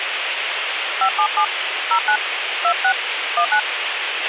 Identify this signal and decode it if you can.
DTMF, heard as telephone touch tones, dialled by hand, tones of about 80 ms, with radio hiss and a squelch burst at the end. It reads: 577 09 26 19